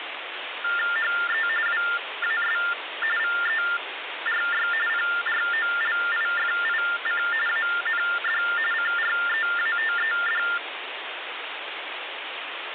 TTY/TDD text telephone tones (45.45 baud Baudot), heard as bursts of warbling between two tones, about 400 Hz shift, 1600 Hz centre, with phone line noise. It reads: HE WAS VERY PROLIFIC AND CREATED